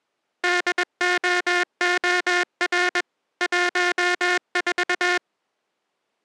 Morse code, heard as a buzzer, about 21 wpm. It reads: DOOR 14